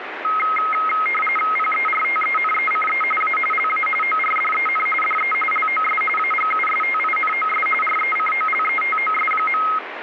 RTTY (45.45 baud, 850 Hz shift), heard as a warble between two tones, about 1700 Hz centre, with radio static. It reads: PERTENECE A LA ORDEN DE LOS AGUSTINOS RECOLETOS.